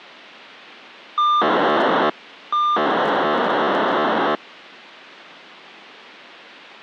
POCSAG pager data (2400 baud), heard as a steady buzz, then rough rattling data.